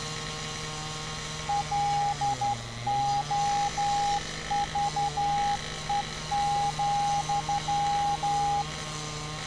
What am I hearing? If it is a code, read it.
Morse code, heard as a keyed tone, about 12 wpm, 810 Hz, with street noise. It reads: LOVE,